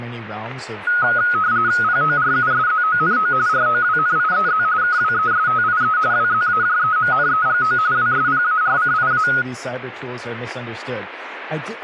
RTTY (45.45 baud, 170 Hz shift), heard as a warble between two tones, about 1360 Hz centre, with static crashes and speech in English. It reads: PORUSZONO ROWNIEZ KWESTIE WZAJEMNEGO WSPARCIA